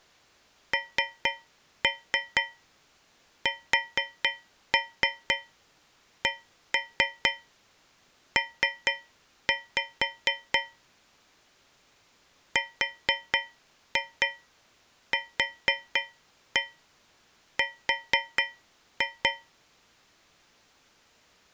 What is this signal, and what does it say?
Tap code, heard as taps on a metal pipe, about 4 knocks a second. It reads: NSCP RQR